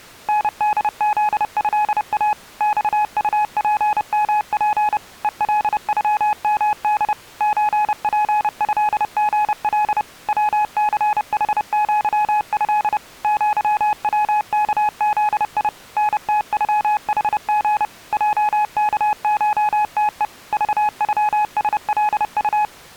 Morse code (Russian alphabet), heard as a keyed tone, machine-sent, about 30 wpm, 840 Hz. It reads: НДЗЭА ЬУПМП ЕЛЮМД ЧПЭГЛ ВЦХЪЭ ЪВКЗИ НТЮХГ ЙКШТЕ ЖЮСЛУ